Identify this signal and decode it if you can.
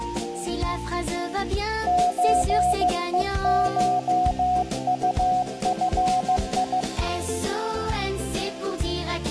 Morse code (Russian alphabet), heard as a keyed tone, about 15 wpm, 730 Hz, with room echo. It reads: ЧЕШУФИ